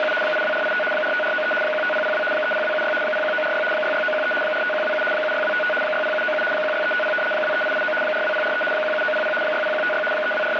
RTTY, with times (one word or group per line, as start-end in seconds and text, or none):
0.0-0.1 …
0.2-0.8 82485
0.9-1.5 45493
1.6-2.2 15002
2.3-2.9 30276
3.0-3.6 01946
3.7-4.3 66913
4.4-5.0 45127
5.1-5.7 76255
5.8-6.4 60797
6.5-7.1 16350
7.3-7.9 23889
8.0-8.6 42043
8.7-9.3 17900
9.4-10.0 60156
10.1-10.6 …